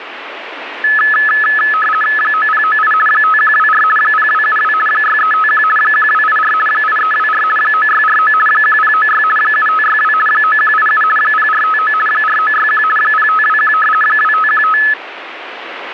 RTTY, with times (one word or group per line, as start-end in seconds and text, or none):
2.2-2.9 9098
3.1-3.8 5124
4.0-4.7 0272
4.9-5.6 6351
5.8-6.5 1284
6.7-7.4 8324
7.6-8.3 9649
8.5-9.2 1096
9.4-10.1 7562
10.3-11.0 9187
11.2-11.9 0459
12.1-12.8 4961
13.0-13.7 0521
14.0-14.8 2515